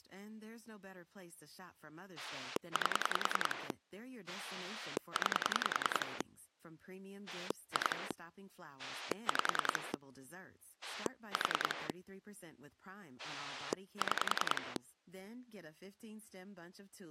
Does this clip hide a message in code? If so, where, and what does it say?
Yes: pulse dialling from 2.2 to 14.8 s, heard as a rotary dial, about 10 pulses a second, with speech in German. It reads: 8 9 2 5 4 6